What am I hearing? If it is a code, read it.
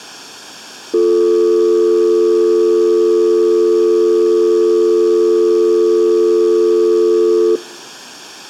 Telephone call progress tone (North American or UK plan), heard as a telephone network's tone, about 350, 440 Hz. Dial tone.